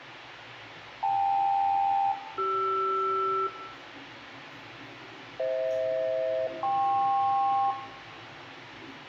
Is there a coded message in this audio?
Yes: aircraft SELCAL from 1.0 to 7.7 s, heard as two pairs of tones, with radio hiss, room echo and the noise inside a subway train. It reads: KL-CR FH-KP